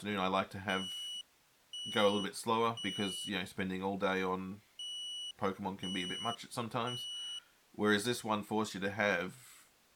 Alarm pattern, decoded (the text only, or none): temporal three